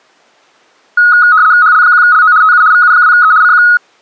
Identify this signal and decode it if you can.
RTTY (75 baud, 170 Hz shift), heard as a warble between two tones, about 1360 Hz centre. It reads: HL1LO TU VU2E CQ